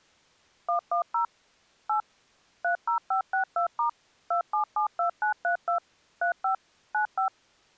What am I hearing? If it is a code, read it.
DTMF, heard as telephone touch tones, dialled by machine, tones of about 110 ms. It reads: 110 8 30562* 2772932 35 95